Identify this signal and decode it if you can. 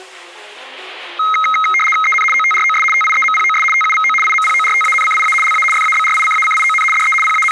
RTTY (75 baud, 850 Hz shift), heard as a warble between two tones, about 1700 Hz centre. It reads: EN OTROS TIEMPOS TUVO IMPORTANCIA LA FABRICACION DE …